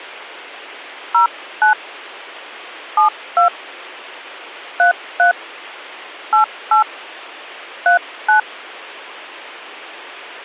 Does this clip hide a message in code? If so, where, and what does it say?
Yes: DTMF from 1.1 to 8.4 s, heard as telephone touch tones, dialled by hand, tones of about 120 ms. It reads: 09 72 33 88 39